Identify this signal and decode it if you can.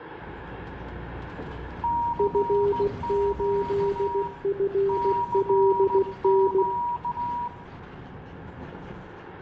Morse code, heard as two keyed tones, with radio static, room echo and the noise inside a bus. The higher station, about 16 wpm, 950 Hz: CQ CQ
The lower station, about 16 wpm, 400 Hz: F8FLN